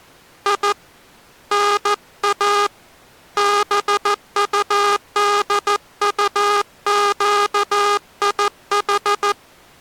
Morse code (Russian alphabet), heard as a buzzer, hand-sent with a paddle, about 14 wpm. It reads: И НА БУДУЩИХ